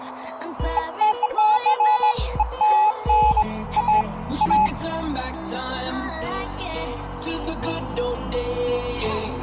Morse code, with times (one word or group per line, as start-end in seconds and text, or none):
none